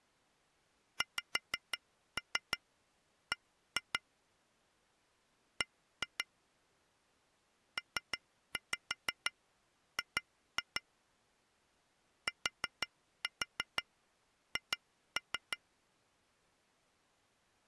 Tap code, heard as taps on glass, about 6 knocks a second. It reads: XB B PG TH